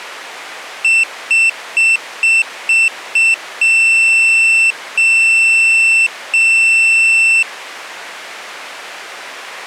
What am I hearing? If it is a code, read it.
Beep code, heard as a piezo beeper, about 2700 Hz. 6 short, 3 long.